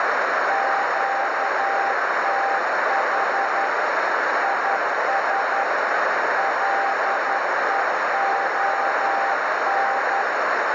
Morse code, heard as a keyed tone, machine-sent, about 11 wpm, 790 Hz, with heavy radio static and a narrow filter. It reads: QTH IS LEON